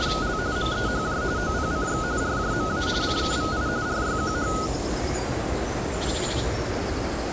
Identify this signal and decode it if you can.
RTTY (45.45 baud, 170 Hz shift), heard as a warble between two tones, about 1360 Hz centre, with radio static. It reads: … MEHJ OPCX RJMA CKVI RYQH